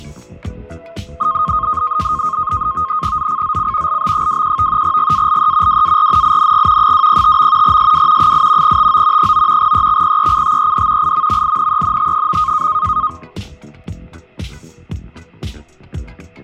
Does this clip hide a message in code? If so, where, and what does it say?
Yes: NAVTEX (SITOR-B), 100 baud, 170 Hz shift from 1.2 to 13.1 s, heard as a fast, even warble, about 1160 Hz centre, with fading. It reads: ZCZC LB21 GALE WARNING 205. SW 8 TO 9 EXPECTED IMMINENT.